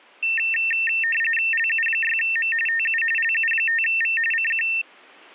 RTTY (45.45 baud, 850 Hz shift), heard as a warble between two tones, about 2250 Hz centre. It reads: LU6M TU LU5V CQ